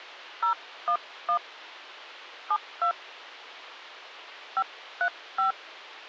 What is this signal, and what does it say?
DTMF, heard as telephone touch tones, dialled by hand, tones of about 90 ms. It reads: 011 72 535